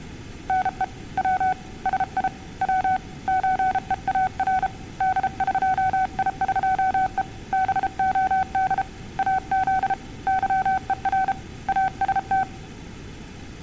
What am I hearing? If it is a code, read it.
Morse code (Persian alphabet), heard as a keyed tone, hand-sent with a paddle, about 33 wpm, 750 Hz. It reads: نه و سی و چهار دقیقه بعد از ظهر است